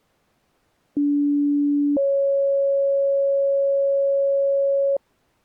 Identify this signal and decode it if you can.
Two-tone page, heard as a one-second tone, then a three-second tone, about 290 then 550 Hz.